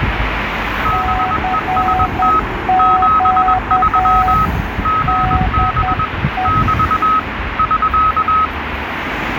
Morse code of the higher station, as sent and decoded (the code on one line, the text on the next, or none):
-... . ... - / --... ...-- / --. -... / -...- / ...-.-
BEST 73 GB <BT> <SK>